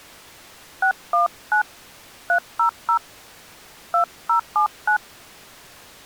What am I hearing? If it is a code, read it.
DTMF, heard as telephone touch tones, dialled by hand, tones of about 110 ms. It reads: 619 300 2079